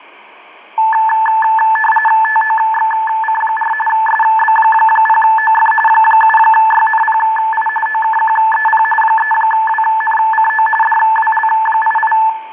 RTTY (45.45 baud, 850 Hz shift), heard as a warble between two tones, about 1310 Hz centre, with room echo. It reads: TOXC4 SB0OF 7YNPI OKQEP 3WNCO DWL88